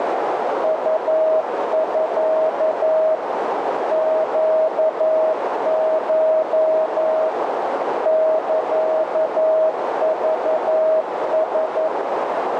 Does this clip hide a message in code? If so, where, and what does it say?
Yes: Morse code (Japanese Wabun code) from 0.6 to 11.9 s, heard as a keyed tone, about 11 wpm, 630 Hz, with heavy radio static and a narrow filter. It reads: ウミ ネコ サクラ